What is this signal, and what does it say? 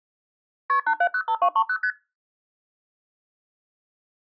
Multi-frequency trunk signalling (R1, as on North American trunks), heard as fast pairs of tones, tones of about 70 ms. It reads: KP 8705230 ST